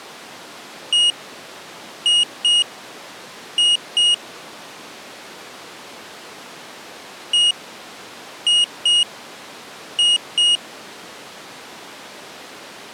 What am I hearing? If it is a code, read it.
Beep code, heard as a piezo beeper, played twice, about 2900 Hz. 1-2-2. In Phoenix BIOS tables: DMA initialisation failure.